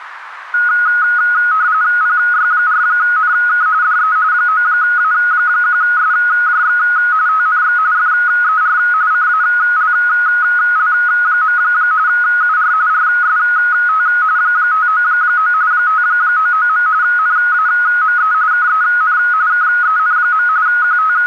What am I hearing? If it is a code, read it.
RTTY (45.45 baud, 170 Hz shift), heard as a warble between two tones, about 1360 Hz centre, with radio static. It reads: PY4NK DE 9A1SJX TNX FER CALL. UR RST 599 599. NAME KEN KEN. …